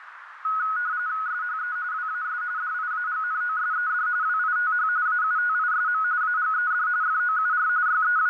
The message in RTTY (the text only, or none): SHE WAS DIAGNOSED WITH AUTISM AGED FOUR …